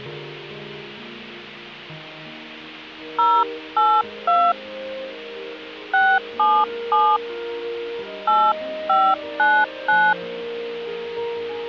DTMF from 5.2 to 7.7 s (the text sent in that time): 677